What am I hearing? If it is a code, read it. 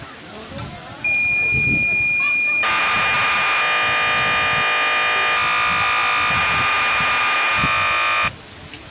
Cassette data (Kansas City type), 1200 baud, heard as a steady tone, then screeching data, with the noise of a park.